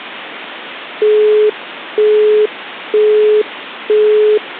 Telephone call progress tone (single-tone plan, as in Europe, Japan and elsewhere), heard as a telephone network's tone, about 420 Hz, 0.48 s on and 0.48 s off. Busy tone.